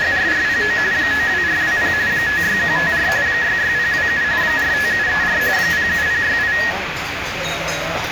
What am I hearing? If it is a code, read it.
RTTY (45.45 baud, 170 Hz shift), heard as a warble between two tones, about 1800 Hz centre, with radio static and the noise of a crowd indoors. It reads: … 92420 56154 66027 45734 07068